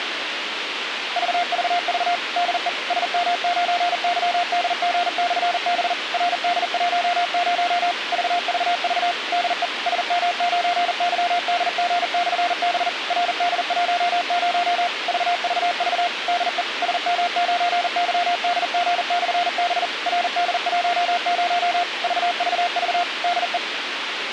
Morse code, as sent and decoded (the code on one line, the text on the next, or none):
...- ...- ...- / -.. . / ... -- ----. -.-- -.. --. -..-. -... / .-. -.. .---- ----- / ...- ...- ...- / -.. . / ... -- ----. -.-- -.. --. -..-. -... / .-. -.. .---- ----- / ...- ...- ...- / -.. . / ... -- ----. -.-- -.. --. -..-. -... / .-. -.. .---- ----- / ...- ...- ...- / -.. .
VVV DE SM9YDG/B RD10 VVV DE SM9YDG/B RD10 VVV DE SM9YDG/B RD10 VVV DE